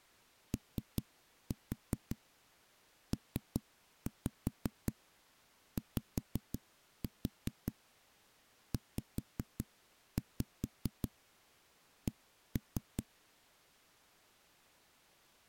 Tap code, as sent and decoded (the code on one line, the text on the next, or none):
3-4 3-5 5-4 5-5 1-3
OPYZC